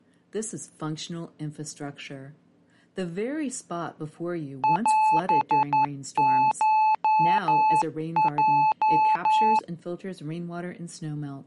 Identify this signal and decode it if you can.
Morse code (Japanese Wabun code), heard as a keyed tone, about 11 wpm, 870 Hz. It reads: オコヲ